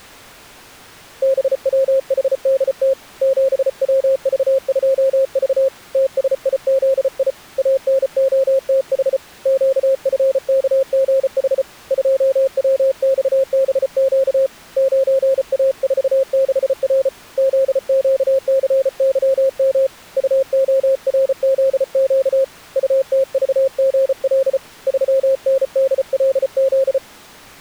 Morse code, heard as a keyed tone, hand-sent with a paddle, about 34 wpm, 540 Hz. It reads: BWHDT 7WV2V TSIZI ANOTH QFKGH 2WXBQ 9A46R ZQCYM UORZQ UTVGL 3NDLZ